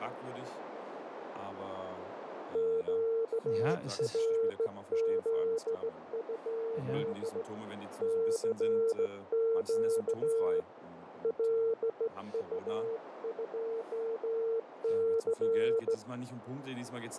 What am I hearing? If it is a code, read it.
Morse code, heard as a keyed tone, hand-sent with a straight key, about 16 wpm, 450 Hz, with radio static, a narrow filter and speech in German. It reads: QRZ? CQ LU2C